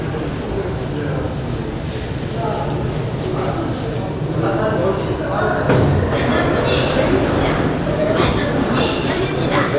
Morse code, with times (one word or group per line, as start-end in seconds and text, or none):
none